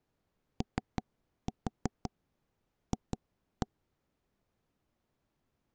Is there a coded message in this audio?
Yes: tap code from 0.6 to 3.7 s, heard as knocks on wood, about 5 knocks a second. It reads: OF